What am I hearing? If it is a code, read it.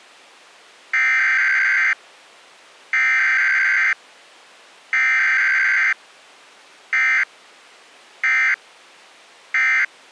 Emergency Alert System (SAME) tones (header bursts, then end-of-message bursts), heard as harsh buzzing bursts, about 520.83 baud.